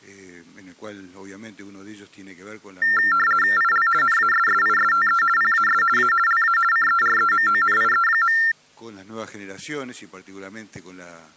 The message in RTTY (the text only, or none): IL NASSISTE PAS A LA CEREMONIE.